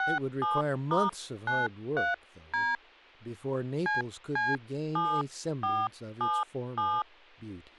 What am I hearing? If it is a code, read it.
DTMF, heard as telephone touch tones, dialled by hand, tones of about 200 ms, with speech in English. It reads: 67*93D CC7477